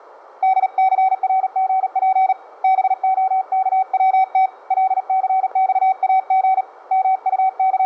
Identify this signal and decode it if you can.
Morse code, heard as a keyed tone, hand-sent with a paddle, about 38 wpm, 760 Hz. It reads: DCRGP BOKWT LCXAG …